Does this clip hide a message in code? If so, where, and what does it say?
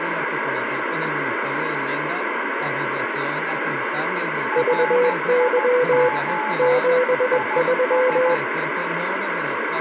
Yes: Morse code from 4.5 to 8.4 s, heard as two keyed tones, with radio static. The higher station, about 14 wpm, 860 Hz: RIG IS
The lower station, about 21 wpm, 500 Hz: VY 73